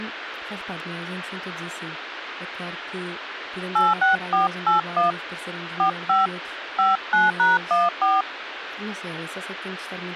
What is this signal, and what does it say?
DTMF, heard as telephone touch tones, dialled by hand, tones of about 160 ms, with phone line noise and speech in Portuguese. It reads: 86481 45 59#14